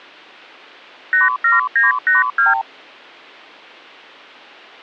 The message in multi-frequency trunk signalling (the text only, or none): 87982